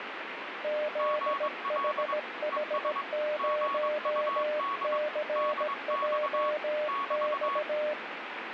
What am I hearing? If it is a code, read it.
Morse code, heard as two keyed tones, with radio static. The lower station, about 17 wpm, 600 Hz: ZHH0CJX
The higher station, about 22 wpm, 1120 Hz: GL ES GUD DX <BT>